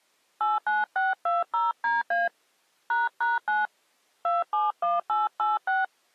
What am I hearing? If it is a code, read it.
DTMF, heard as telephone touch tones, dialled by hand, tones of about 180 ms. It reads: 89620DA ##9 271886